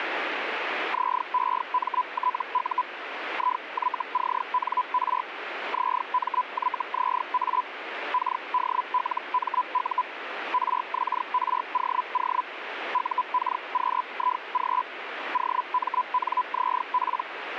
Hellschreiber (Feld-Hell, 122.5 baud), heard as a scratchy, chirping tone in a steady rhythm, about 1000 Hz, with radio static. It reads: ZEMTU IYCNR ZMYZA KDLMU RXROO UKQIG OMNZP